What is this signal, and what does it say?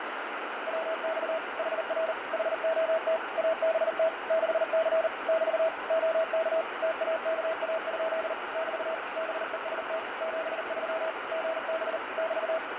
Morse code, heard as a keyed tone, machine-sent, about 39 wpm, 650 Hz, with heavy radio static and fading. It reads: WX HR HOT ABT 6C <BT> OK TAKA? <BT> BEST 73 GB <BT>